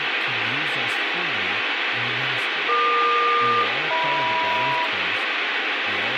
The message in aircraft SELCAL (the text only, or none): EQ-HM